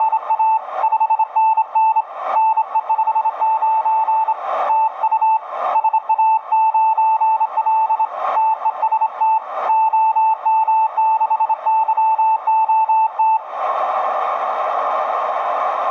Morse code, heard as a keyed tone, hand-sent with a straight key, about 27 wpm, 880 Hz, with radio static and a narrow filter. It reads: … 5NN NE59 TU SA9L TEST OM6YOT